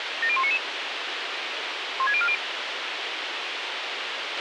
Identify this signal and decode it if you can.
Five-tone selective call (ZVEI), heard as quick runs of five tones, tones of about 70 ms, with radio hiss and a squelch burst at the end. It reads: 70199 16040